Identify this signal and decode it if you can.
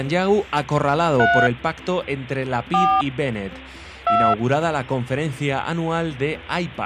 DTMF, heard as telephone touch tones, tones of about 270 ms. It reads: 3 4 2